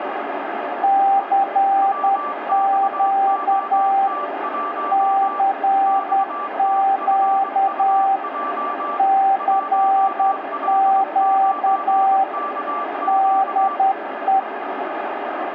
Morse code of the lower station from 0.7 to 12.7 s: CQ CQ CQ

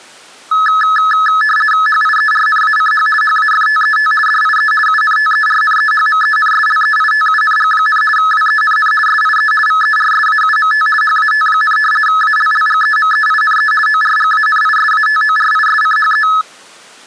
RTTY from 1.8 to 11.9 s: HIERNACH HAFTET DIE UNTERNEHMENSLEITUNG, WENN SIE VERSAUMT HAT,

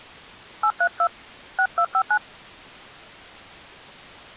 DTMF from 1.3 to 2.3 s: 6259

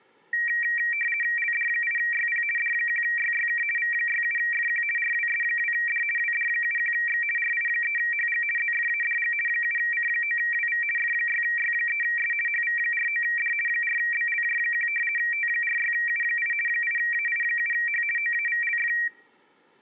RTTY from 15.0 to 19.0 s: T46U8 8AI7H OAVLF

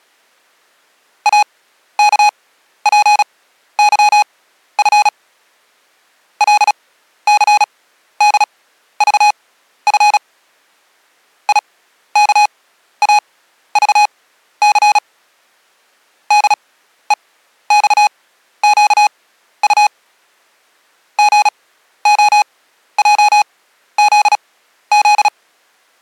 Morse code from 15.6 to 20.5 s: DEXQU

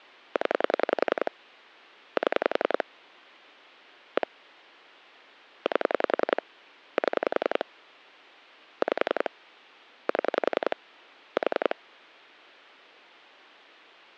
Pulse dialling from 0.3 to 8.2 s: 0 7 1 8 7

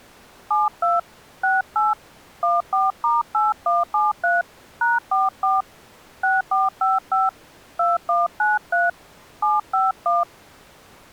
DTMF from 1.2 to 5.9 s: 68 14*8173 #44

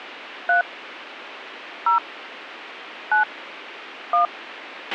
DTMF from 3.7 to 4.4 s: 1

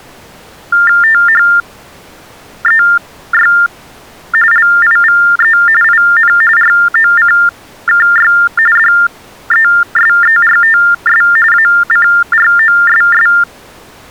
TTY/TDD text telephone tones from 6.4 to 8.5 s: ROCKY

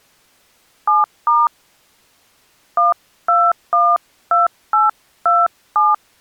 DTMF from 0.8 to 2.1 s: 7*

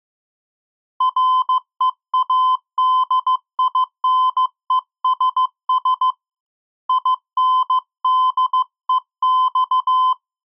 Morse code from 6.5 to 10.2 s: INDEX

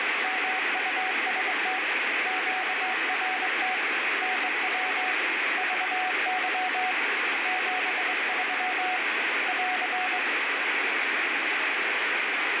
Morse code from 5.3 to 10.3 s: VY 73 <AR>

